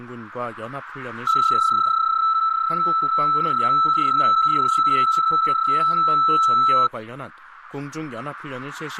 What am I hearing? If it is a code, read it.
PSK31 (31.25 baud), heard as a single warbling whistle, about 1320 Hz, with radio static.